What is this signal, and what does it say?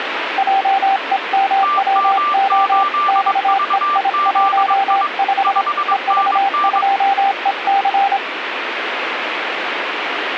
Morse code, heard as two keyed tones, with radio static. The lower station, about 26 wpm, 780 Hz: JEMWO XEI15 EV2EC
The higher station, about 22 wpm, 1180 Hz: TM8VZI 5NN